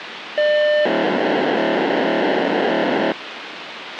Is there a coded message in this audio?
Yes: POCSAG pager data (1200 baud) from 0.4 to 3.1 s, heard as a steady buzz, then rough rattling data, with radio hiss and a squelch burst at the end.